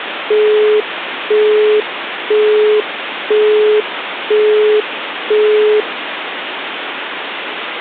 Telephone call progress tone (single-tone plan, as in Europe, Japan and elsewhere), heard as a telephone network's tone, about 420 Hz, 0.5 s on and 0.5 s off, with phone line noise. Busy tone.